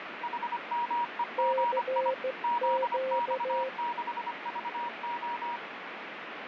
Morse code, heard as two keyed tones, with radio static. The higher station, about 25 wpm, 950 Hz: HMEGI ZX6VO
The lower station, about 15 wpm, 520 Hz: CQ